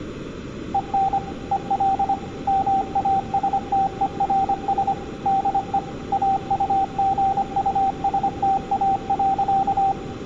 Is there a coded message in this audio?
Yes: Morse code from 0.7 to 10.0 s, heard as a keyed tone, machine-sent, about 25 wpm, 780 Hz, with room echo. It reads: EN EL MASTERS DE AUGUSTA.